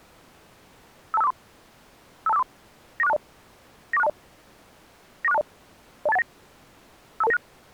Five-tone selective call (EIA), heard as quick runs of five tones, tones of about 30 ms. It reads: 52543 52543 94620 94620 94620 02819 52296